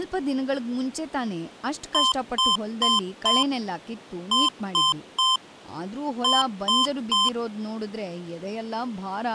Beep code, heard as beeps from a small speaker, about 1040 Hz, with speech in Kannada. 4-3-3. In Phoenix BIOS tables: timer channel 2 failure.